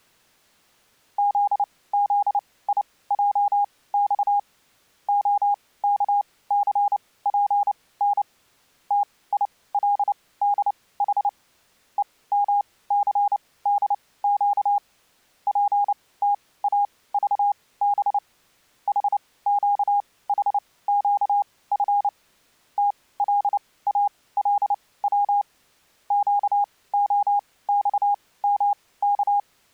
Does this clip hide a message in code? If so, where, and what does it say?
Yes: Morse code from 1.1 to 29.5 s, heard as a keyed tone, machine-sent, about 29 wpm, spaced as for 19 wpm, 810 Hz. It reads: ZZIJX OKCPN TILDH EMCDQ PTAVB HQHQF TLALW QOXMK